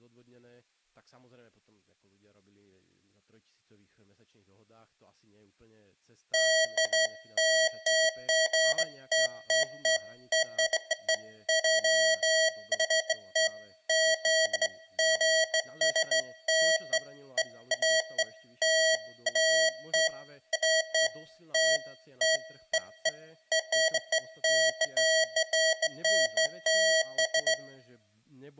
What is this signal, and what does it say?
Beeps of irregular length, with room echo and speech in Slovak. There is no code.